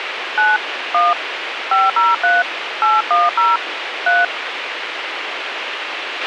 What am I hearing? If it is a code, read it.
DTMF, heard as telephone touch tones, dialled by hand, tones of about 190 ms, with radio hiss and a squelch burst at the end. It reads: 9 1 503 810 3